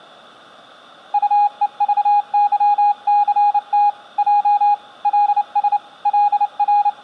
Morse code, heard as a keyed tone, hand-sent with a bug key, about 29 wpm, 820 Hz. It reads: UEVYCT J LS …